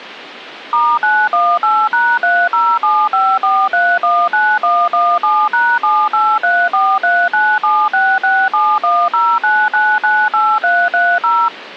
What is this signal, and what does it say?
DTMF, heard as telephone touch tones, dialled by machine, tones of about 250 ms. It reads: *918#30754319117#7834397667109998330